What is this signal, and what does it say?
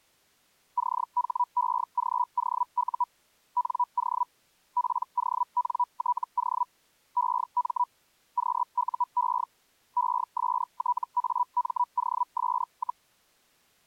Hellschreiber (Feld-Hell, 122.5 baud), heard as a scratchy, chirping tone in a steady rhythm, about 980 Hz. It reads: CHEGOU NO PONTO EM QUE ESTAMOS,